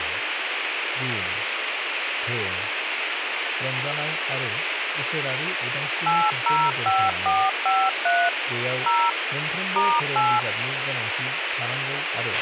DTMF, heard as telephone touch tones, dialled by machine, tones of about 240 ms, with radio hiss, a squelch burst at the end and speech in Bodo. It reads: 805453 0 *8